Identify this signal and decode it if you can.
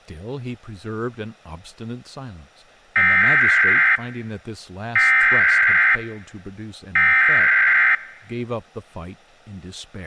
Emergency Alert System (SAME) tones (header bursts), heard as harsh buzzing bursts, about 520.83 baud, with speech in English.